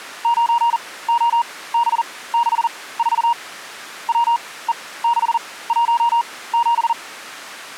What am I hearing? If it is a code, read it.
Morse code, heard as a keyed tone, machine-sent, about 40 wpm, spaced as for 20 wpm, 950 Hz. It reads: 9OB64 WE617